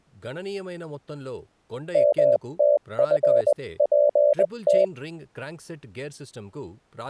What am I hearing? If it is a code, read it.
Morse code (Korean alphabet), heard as a keyed tone, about 20 wpm, 580 Hz, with speech in Telugu. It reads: 먼저